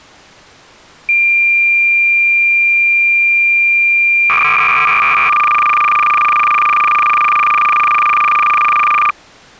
Cassette data (Kansas City type), 300 baud, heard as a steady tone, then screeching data.